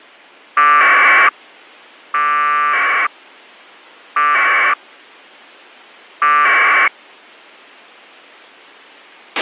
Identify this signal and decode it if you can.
Packet radio (AX.25, as in APRS), 1200 baud, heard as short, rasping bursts, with a squelch burst at the end.